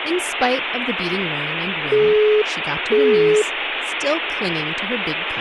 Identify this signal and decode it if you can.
Telephone call progress tone (single-tone plan, as in Europe, Japan and elsewhere), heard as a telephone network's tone, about 420 Hz, 0.5 s on and 0.5 s off, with phone line noise and speech in English. Busy tone.